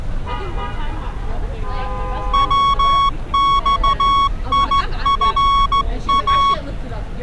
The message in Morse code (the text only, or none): WXIFA